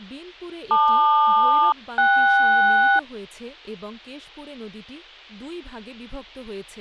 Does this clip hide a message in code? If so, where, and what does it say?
Yes: aircraft SELCAL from 0.7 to 3.0 s, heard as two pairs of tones, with speech in Bangla. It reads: LQ-KS